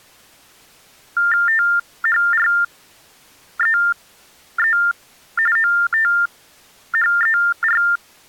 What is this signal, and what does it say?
TTY/TDD text telephone tones (45.45 baud Baudot), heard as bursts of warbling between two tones, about 400 Hz shift, 1600 Hz centre. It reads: THREE OTHER